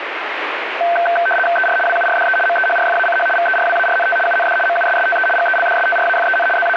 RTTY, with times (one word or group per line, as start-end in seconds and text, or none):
1.6-1.8 ER
1.9-2.4 WURDE
2.5-3.3 MEHRFACH
3.4-4.2 VERWARNT
4.3-4.6 UND
4.7-5.3 MUSSTE
5.4-6.5 GELDSTRAFEN
6.6-6.8 …